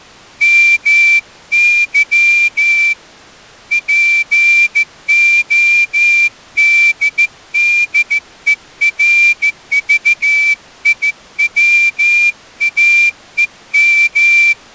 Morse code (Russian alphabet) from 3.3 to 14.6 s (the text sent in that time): ПОДДЕРЖИВАЕМ